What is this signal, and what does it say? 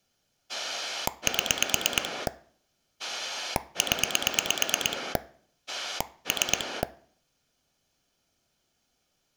Pulse dialling, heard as a rotary dial, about 8 pulses a second. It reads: 7 0 3